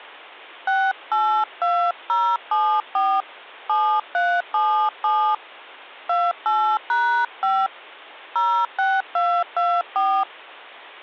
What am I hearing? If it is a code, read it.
DTMF, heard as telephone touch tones, dialled by hand, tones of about 280 ms. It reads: 682074 7377 28#5 06224